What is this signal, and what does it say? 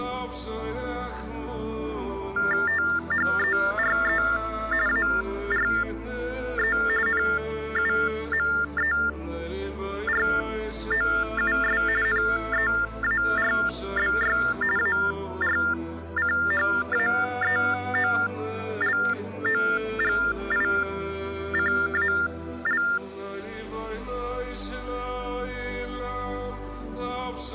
TTY/TDD text telephone tones (45.45 baud Baudot), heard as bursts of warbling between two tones, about 400 Hz shift, 1600 Hz centre. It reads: THERE ARE NUMEROUS NEARBY ARCHAEOLOGICAL